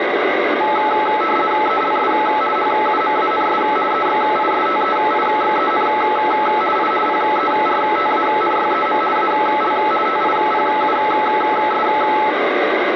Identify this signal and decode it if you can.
RTTY (50 baud, 450 Hz shift), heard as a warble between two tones, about 1080 Hz centre, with radio static. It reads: ELS HUMANS EXISTEIXEN I PERTANYEM AL TIPUS